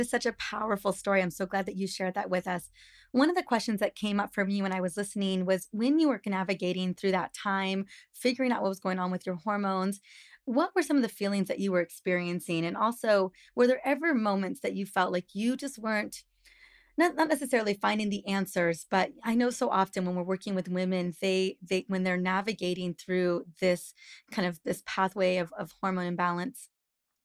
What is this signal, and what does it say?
Speech in English. There is no code.